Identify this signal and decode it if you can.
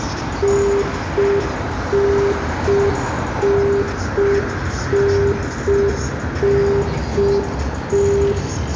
Telephone call progress tone (UK plan), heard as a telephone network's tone, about 400 Hz, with room echo and street noise. Congestion tone.